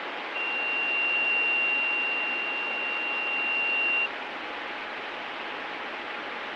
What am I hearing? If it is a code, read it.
A steady tone, with radio static. There is no code.